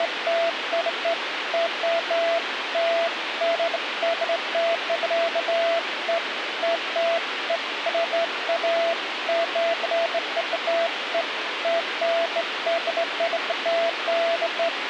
Beeps of irregular length, with radio hiss. There is no code.